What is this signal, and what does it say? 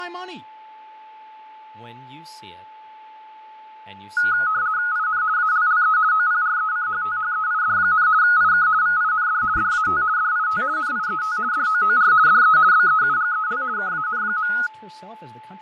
RTTY (50 baud, 170 Hz shift), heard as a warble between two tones, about 1360 Hz centre, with fading, a steady whistle near 870 Hz and speech in English. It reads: IN ALLE OPRECHTHEID, IK VIND DAT DIT NIET DOOR DE BEUGEL KAN.